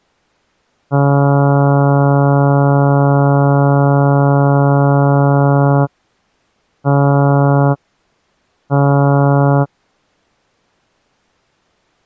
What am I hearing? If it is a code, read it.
Ship horn signal, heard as a ship's horn, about 140 Hz. 1 long, 2 short. At sea: a vessel in fog that is sailing, fishing, towing or hampered.